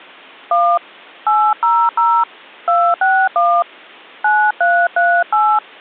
DTMF, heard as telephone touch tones, dialled by hand, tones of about 260 ms. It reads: 1 800 261 9338